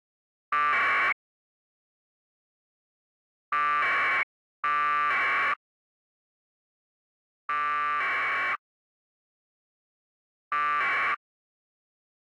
Packet radio (AX.25, as in APRS), 1200 baud, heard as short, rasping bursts.